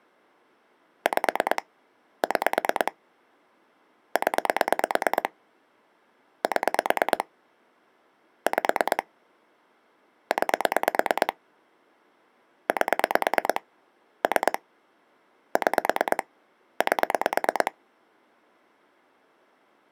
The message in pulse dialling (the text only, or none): 5 6 0 7 5 9 8 3 6 8